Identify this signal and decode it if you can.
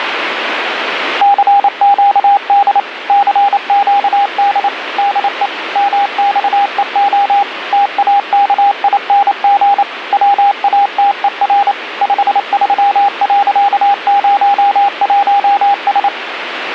Morse code, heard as a keyed tone, machine-sent, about 28 wpm, 800 Hz, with radio static. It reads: CQD CQD DE MXEO TAKING WATER 53.01S